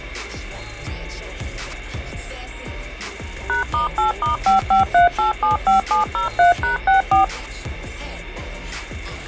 DTMF, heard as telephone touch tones, dialled by machine, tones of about 130 ms. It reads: #*8*553875703#64